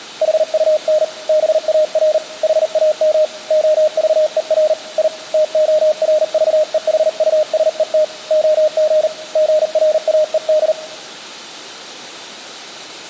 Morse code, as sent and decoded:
.... ..- -. / -... .- .-. / .... .- -- / --- ...- . .-. / .. / - --- .-. ...- . .... ..- ... . - / --- --. / --. .-. .- . -..
HUN BAR HAM OVER I TORVEHUSET OG GRAED

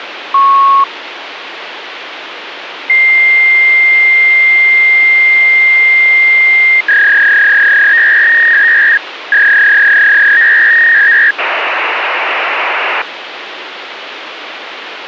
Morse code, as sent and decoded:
none

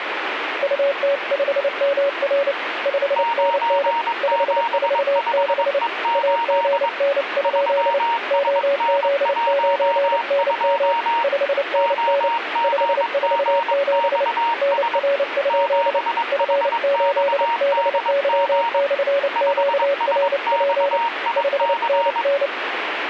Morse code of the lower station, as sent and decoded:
..- - ..... -- .-. / ..... -. -. / ..... ....- -.... / .- --. -. ..--.. / --- --.. ----. -. -- / ..... -. -. / ..... ....- --... / -. .-. ..--.. / ..-. ---.. -... -.-- -..-. --.- .-. .--. / ..... -. -.
UT5MR 5NN 546 AGN? OZ9NM 5NN 547 NR? F8BY/QRP 5NN

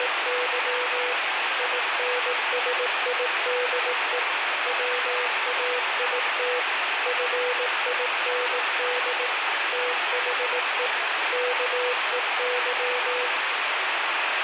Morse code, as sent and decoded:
… / .. -. ... .. -.. . / .-- .- .. - / ..-. .. -. -.. / - .... . / -.- . -.--
… INSIDE WAIT FIND THE KEY

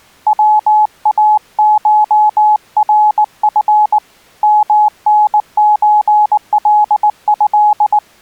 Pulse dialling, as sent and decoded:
none

